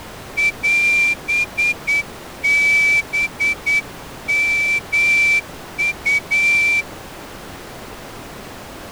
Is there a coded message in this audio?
Yes: Morse code (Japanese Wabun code) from 0.3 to 6.9 s, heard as a whistle, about 9 wpm. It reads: オハヨウ